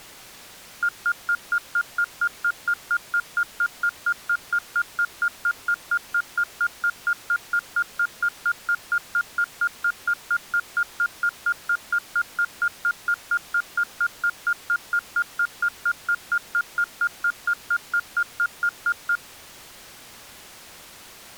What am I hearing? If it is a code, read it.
Evenly repeated beeps. There is no code.